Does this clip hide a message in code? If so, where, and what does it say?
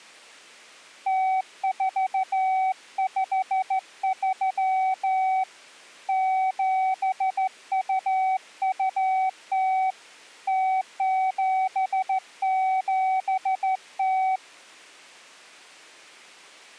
Yes: Morse code (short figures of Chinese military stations) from 1.0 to 14.4 s, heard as a keyed tone, hand-sent with a straight key, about 14 wpm, 760 Hz. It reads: 0453 7220 0770